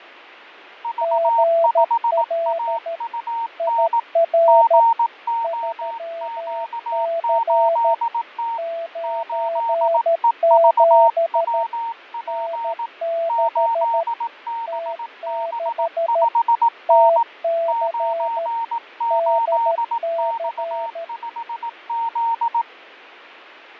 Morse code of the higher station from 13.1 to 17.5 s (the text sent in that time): 8BB5N